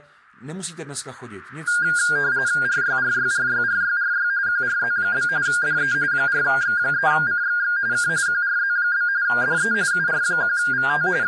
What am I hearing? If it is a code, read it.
RTTY (45.45 baud, 170 Hz shift), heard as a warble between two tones, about 1500 Hz centre, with speech in Czech. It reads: RYRYRYRYRY QRZ? DE 4X3CXX K QRZ? DE UR1VT …